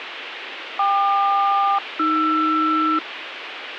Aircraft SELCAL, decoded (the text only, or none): KQ-AR